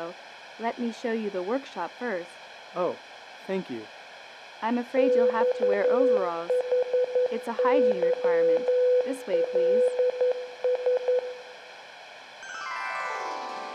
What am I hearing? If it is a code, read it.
Morse code (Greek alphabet), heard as a keyed tone, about 11 wpm, 500 Hz, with room echo. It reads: ΞΗΥΛΣ